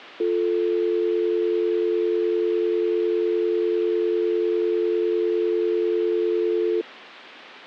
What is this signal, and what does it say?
Telephone call progress tone (North American or UK plan), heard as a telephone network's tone, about 350, 440 Hz. Dial tone.